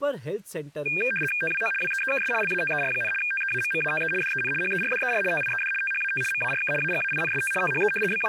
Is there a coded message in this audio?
Yes: RTTY (75 baud, 850 Hz shift) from 0.9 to 8.3 s, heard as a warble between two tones, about 2000 Hz centre, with speech in Hindi. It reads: TWO WEEKS LATER, TEAMMATE DEN HERDER TIED THAT MARK AGAINST THE …